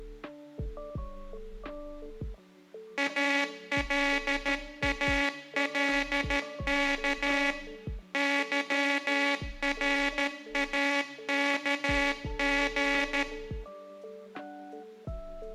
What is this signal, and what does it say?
Morse code, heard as a buzzer, machine-sent, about 13 wpm, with room echo. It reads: ALALK YRAKG